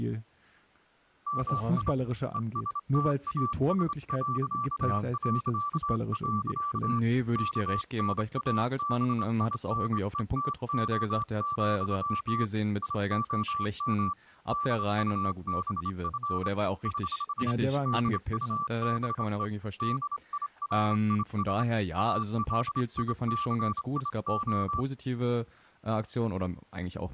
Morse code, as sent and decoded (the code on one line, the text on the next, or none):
-- .. / . ... - .- ... .-.-.- .-.-.- .-.-.- / -.- -. .- -... .. -. . - --- --..-- / .. --- -- / -.. ..- -... ..-. / ........ / -.. ..- -... . / -.. .. .-. .. ... / .- .-.. .. -.-. .. ---
MI ESTAS... KNABINETO, IOM DUBF <HH> DUBE DIRIS ALICIO